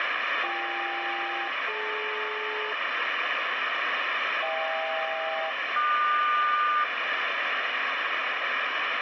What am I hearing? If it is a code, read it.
Aircraft SELCAL, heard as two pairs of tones, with heavy radio static. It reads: BK-DL HK-QS